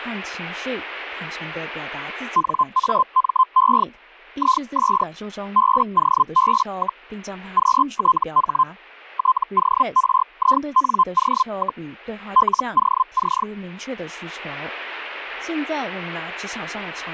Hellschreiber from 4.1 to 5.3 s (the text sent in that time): IS